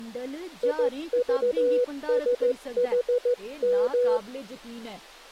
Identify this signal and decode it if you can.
Morse code, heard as a keyed tone, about 15 wpm, 490 Hz, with speech in Dogri. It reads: IVSHM